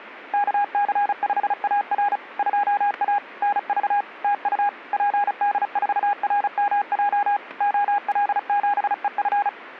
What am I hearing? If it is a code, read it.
Morse code, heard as a keyed tone, machine-sent, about 35 wpm, 820 Hz, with static crashes. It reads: KC5AR 2A NV TU PD4RMJ OL7EF